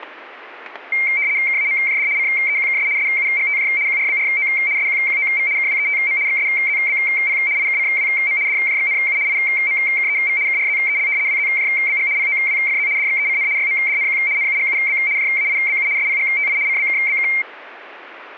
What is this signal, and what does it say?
RTTY (75 baud, 170 Hz shift), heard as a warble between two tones, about 2200 Hz centre. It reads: KAMJD CEQKS SUGTJ QRBRO SQQOV KWETM XSZBP IKCWM DJXNU IMKEV KRZEL WZJBG POWFZ DXECN YMDNQ NUGUB JAIBU SPGTI CBKBK